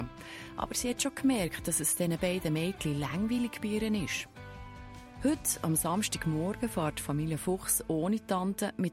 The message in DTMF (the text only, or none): none